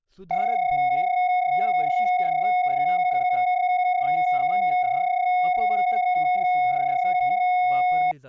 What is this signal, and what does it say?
PSK31 (31.25 baud), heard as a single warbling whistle, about 730 Hz, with speech in Marathi.